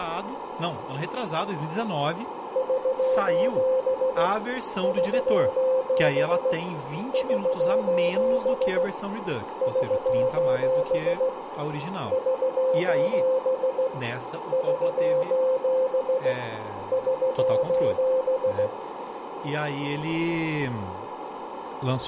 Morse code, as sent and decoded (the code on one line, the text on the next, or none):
...---... / ...---... / ...---... / ...---... / ...---... / ...---... / ...---...
<SOS> <SOS> <SOS> <SOS> <SOS> <SOS> <SOS>